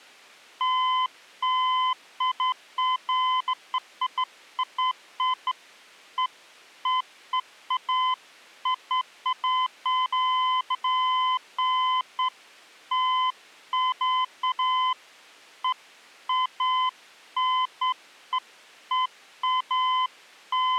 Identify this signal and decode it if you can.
Beeps of irregular length. There is no code.